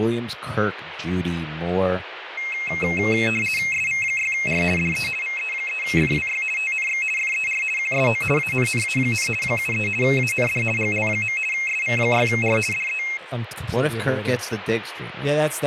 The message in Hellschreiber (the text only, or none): none